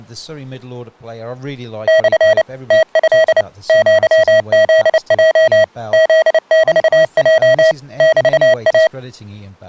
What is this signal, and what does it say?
Morse code (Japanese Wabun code), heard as electronic beeps, machine-sent, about 29 wpm, 640 Hz, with speech in English. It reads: モ ムト アフヲ フメヲ メイ